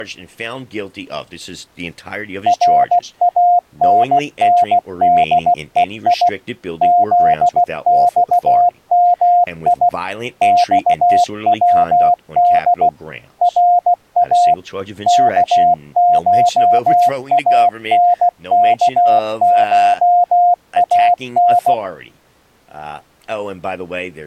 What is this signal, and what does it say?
Morse code (Persian alphabet), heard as a keyed tone, machine-sent, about 16 wpm, 710 Hz, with speech in English. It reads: رانندهی زخمی خود را کشانکشان